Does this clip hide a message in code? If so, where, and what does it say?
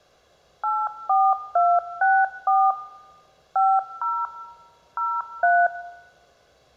Yes: DTMF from 0.6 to 5.7 s, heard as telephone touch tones, dialled by machine, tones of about 240 ms, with room echo. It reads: 84264 50 03